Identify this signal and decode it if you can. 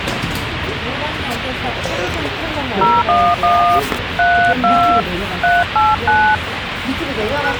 DTMF, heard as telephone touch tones, dialled by hand, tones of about 280 ms, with radio hiss and the noise of a subway station. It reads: 011 32 389